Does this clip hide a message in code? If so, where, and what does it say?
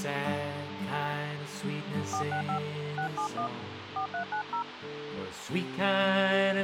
Yes: DTMF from 2.1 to 4.6 s, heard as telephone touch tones, dialled by hand, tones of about 100 ms, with radio hiss. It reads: 465 671 4390